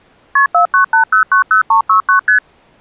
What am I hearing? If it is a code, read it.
Multi-frequency trunk signalling (R1, as on North American trunks), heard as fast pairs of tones, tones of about 110 ms. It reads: KP 498090369 ST